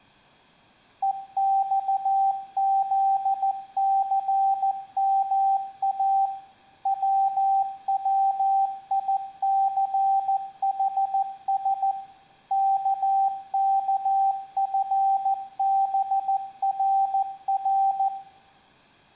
Morse code, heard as a keyed tone, machine-sent, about 14 wpm, 780 Hz, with room echo. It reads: EXZCMA WWICHS KKFBRR